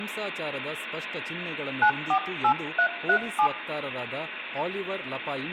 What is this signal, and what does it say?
DTMF, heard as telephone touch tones, dialled by hand, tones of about 80 ms, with phone line noise, room echo and speech in Kannada. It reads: 948337